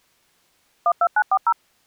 DTMF, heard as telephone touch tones, dialled by machine, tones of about 60 ms. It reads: 12940